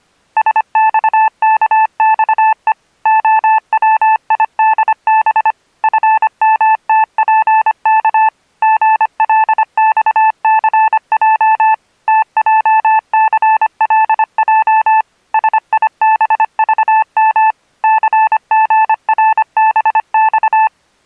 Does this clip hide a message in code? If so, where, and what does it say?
Yes: Morse code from 0.3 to 20.7 s, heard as a keyed tone, machine-sent, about 25 wpm, 880 Hz. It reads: SXKXE OWIDB FMTPK GLXCJ TJCLJ SIBVM CGRBX